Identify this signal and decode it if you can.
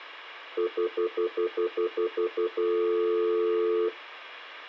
Telephone call progress tone (North American plan), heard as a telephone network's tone, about 350, 440 Hz, 0.1 s on and 0.1 s off. Stutter dial tone.